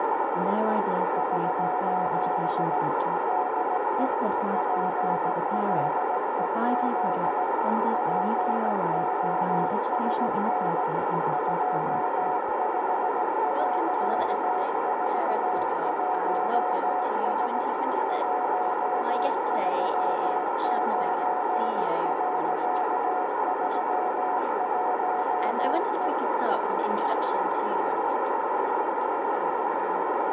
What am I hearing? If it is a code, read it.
Morse code, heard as a keyed tone, machine-sent, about 17 wpm, 730 Hz, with heavy radio static and a narrow filter. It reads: <SOS> DE PLEZ POSN 25.41S 139.31E